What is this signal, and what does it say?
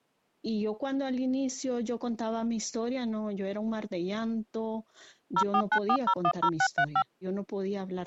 DTMF, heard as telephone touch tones, dialled by machine, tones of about 70 ms. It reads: 0494010635